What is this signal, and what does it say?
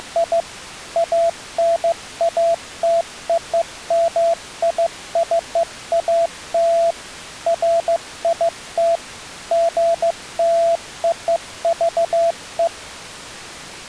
Morse code (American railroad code), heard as a keyed tone, machine-sent, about 670 Hz. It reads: … ANATOMICAL FIT GLOVE